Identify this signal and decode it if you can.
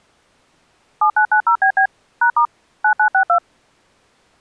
DTMF, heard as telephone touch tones, dialled by machine, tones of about 90 ms. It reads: 7990BB #* 9962